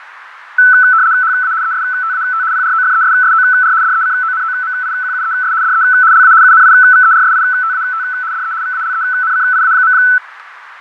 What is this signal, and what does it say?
RTTY (75 baud, 170 Hz shift), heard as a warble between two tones, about 1410 Hz centre, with radio static, fading and a narrow filter. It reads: HA ESTAT PROFESSOR DECONOMIQUES DE LA UNIVERSITAT DE VALENCIA.